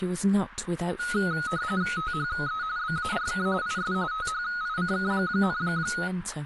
RTTY (45.45 baud, 170 Hz shift), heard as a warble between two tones, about 1360 Hz centre, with radio static and speech in English. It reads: THE BARK IS THICK,